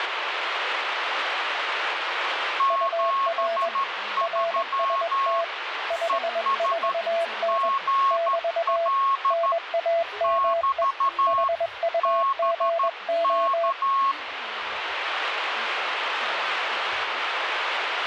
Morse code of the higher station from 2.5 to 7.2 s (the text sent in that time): 73 ES